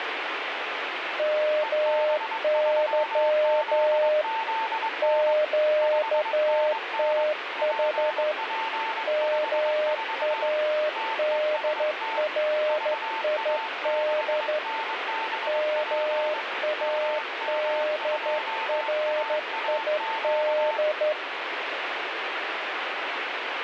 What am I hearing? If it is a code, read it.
Morse code, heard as two keyed tones, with radio static. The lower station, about 12 wpm, 610 Hz: MY QTH MADRID MADRID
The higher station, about 22 wpm, 890 Hz: EB3ZZN 5NN PP54 TEST VA6NBP MM2AAQ